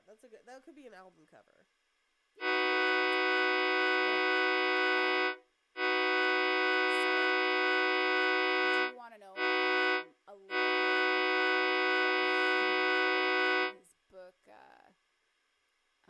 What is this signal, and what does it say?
Train horn signal, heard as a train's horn, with speech in English. 2 long, 1 short, 1 long. On North American railways: approaching a public crossing.